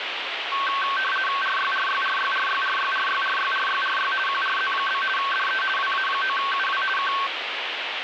RTTY (50 baud, 450 Hz shift), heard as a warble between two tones, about 1330 Hz centre, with radio static. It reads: RYRYRYRYRYRYRYRYRY QRZ? DE WA9UW K